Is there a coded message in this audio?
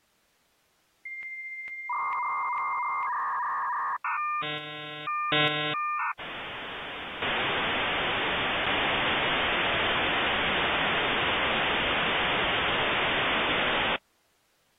Yes: dial-up modem handshake (V.34 or later) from 1.1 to 14.0 s, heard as a whistle, warbles, then hiss.